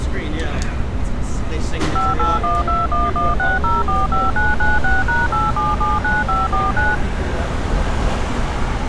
DTMF, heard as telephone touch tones, dialled by machine, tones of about 180 ms, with street noise. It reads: 5812116045996#8779549